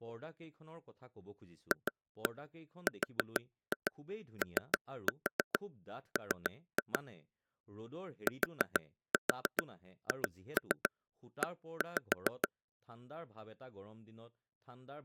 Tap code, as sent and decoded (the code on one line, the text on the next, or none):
2-1 4-2 3-4 3-2 / 4-4 2-3 1-5
FROM THE